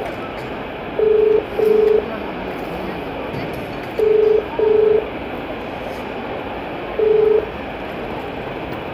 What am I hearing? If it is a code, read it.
Telephone call progress tone (as in the UK, Ireland, Australia and similar networks), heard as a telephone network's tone, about 430 Hz, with room echo and the noise of a crowd indoors. Ringback tone.